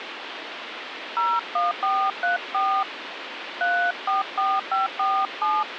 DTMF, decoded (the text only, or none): 01434 344547